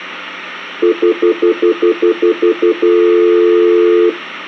Telephone call progress tone (North American plan), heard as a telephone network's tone, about 350, 440 Hz, 0.1 s on and 0.1 s off, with hum. Stutter dial tone.